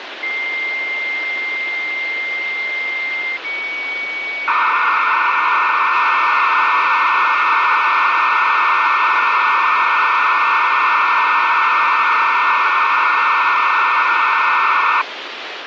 Dial-up modem handshake (low-speed, two carriers), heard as two whistles, then hiss, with phone line noise.